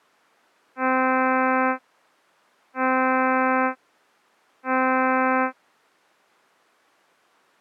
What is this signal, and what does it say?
Ship horn signal, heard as a ship's horn, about 260 Hz. 3 short. At sea: I am operating astern propulsion.